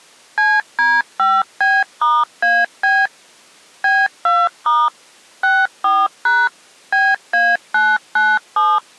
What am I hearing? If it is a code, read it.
DTMF, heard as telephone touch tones, dialled by machine, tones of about 220 ms. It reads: CD5B*AB B2* 64# BA997